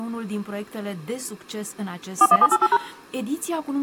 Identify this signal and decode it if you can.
DTMF, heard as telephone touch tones, dialled by machine, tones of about 50 ms. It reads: 41788#